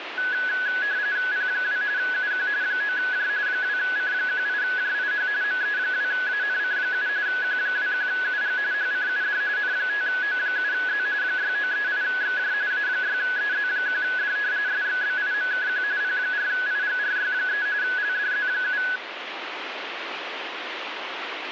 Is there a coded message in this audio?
Yes: RTTY (45.45 baud, 170 Hz shift) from 0.2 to 19.0 s, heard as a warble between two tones, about 1600 Hz centre, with radio static. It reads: P2 UQ 9J 2C18JIH ME2ANC7 Q21UG HCUD N5O7Z 6938XJ A6EZ1D SXBIMKQ P4IGRY3 LDZ7